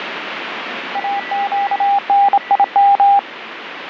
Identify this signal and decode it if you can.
Morse code, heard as a keyed tone, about 27 wpm, 800 Hz, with radio static and a weaker station near 1960 Hz. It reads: AQNIM